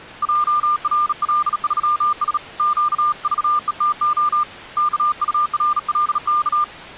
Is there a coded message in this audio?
Yes: Morse code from 0.2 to 6.7 s, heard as a keyed tone, hand-sent with a bug key, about 37 wpm, 1200 Hz. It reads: JRL3S QVETO KURLK